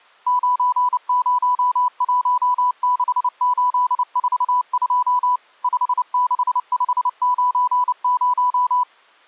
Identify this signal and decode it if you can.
Morse code, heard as a keyed tone, machine-sent, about 29 wpm, 990 Hz. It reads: 9016842 56590